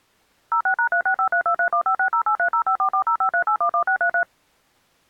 DTMF, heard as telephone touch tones, dialled by machine, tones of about 90 ms. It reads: 06#3653231560830544053811633